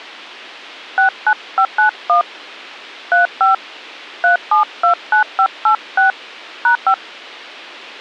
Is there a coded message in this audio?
Yes: DTMF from 1.0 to 6.9 s, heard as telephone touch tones, dialled by hand, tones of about 100 ms. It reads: 69591 35 3729586 #5